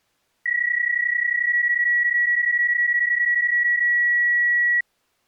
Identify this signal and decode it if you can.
PSK31 (31.25 baud), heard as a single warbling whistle, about 1950 Hz.